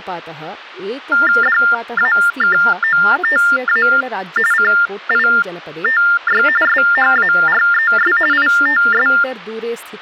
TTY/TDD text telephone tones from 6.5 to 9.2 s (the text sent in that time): SHARES ITS